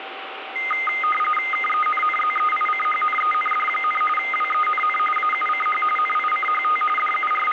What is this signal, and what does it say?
RTTY (45.45 baud, 850 Hz shift), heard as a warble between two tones, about 1650 Hz centre, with radio static. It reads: KENNZEICHNEND, WENN AUCH NICHT …